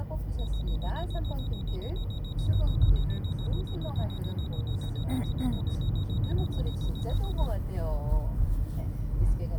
Evenly repeated beeps, with the noise inside a car. There is no code.